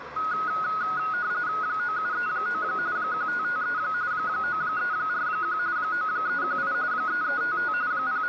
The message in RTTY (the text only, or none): 9739 1553 9341 9318 3355 …